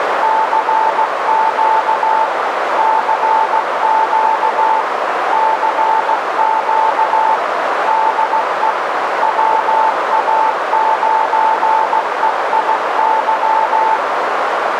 Morse code, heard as a keyed tone, machine-sent, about 16 wpm, 880 Hz, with heavy radio static and a narrow filter. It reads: CQ CQ CQ DE WA9EIY